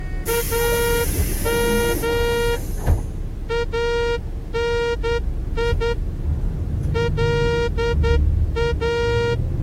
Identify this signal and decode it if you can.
Morse code (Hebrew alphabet), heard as a horn, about 10 wpm, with the noise inside a bus. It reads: אם אני לא